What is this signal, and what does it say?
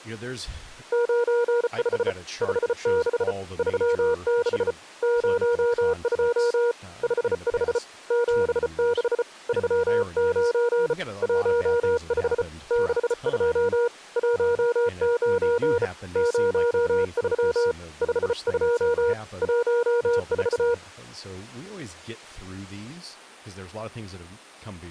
Morse code, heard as a keyed tone, hand-sent with a bug key, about 34 wpm, 480 Hz, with speech in English. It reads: 95 56 36 02 55 76 39 15 62 19 03 52 14